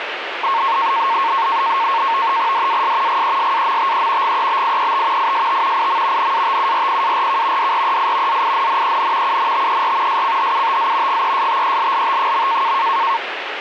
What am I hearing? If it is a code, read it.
NAVTEX (SITOR-B), 100 baud, 170 Hz shift, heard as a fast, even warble, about 1000 Hz centre, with radio static. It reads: DAS GESAMTE GEBIET IST IM NATURPARK DREI ZINNEN UNTER SCHUTZ GESTELLT.